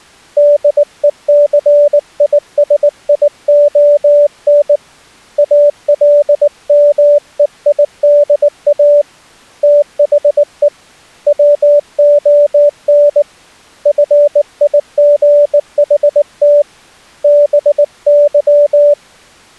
Morse code, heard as a keyed tone, hand-sent with a bug key, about 19 wpm, 580 Hz. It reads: DECISION ALMEIDA THE WON FIGHT BY